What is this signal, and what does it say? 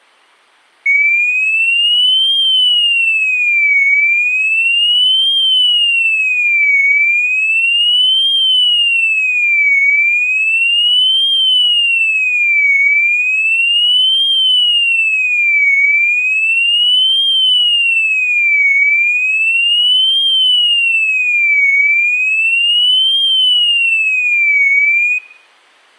A tone that sweeps in pitch again and again. There is no code.